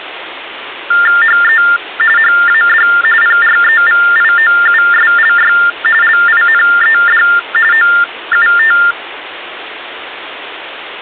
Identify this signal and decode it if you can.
TTY/TDD text telephone tones (45.45 baud Baudot), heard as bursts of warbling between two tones, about 400 Hz shift, 1600 Hz centre, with phone line noise. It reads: HE HAD PREVIOUSLY LINED OUT